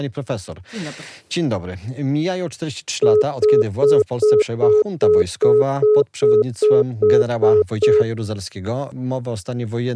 Telephone call progress tone (single-tone plan, as in most of Europe), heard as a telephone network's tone, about 420 Hz, 0.2 s on and 0.2 s off. Congestion tone.